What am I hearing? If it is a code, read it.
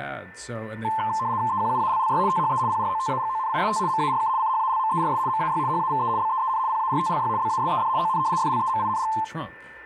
RTTY (75 baud, 170 Hz shift), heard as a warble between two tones, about 960 Hz centre, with a steady whistle near 1780 Hz and speech in English. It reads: EQUALLY THE PROTAGONIST MARK CHALMERS MAY HAVE BEEN PARTLY BASED ON FLEMING